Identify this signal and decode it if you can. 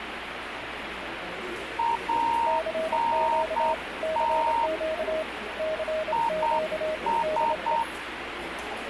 Morse code, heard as two keyed tones, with radio static and the noise of a subway station. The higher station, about 8 wpm, 920 Hz: ANT IS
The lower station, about 27 wpm, 630 Hz: CQ CQ CQ DE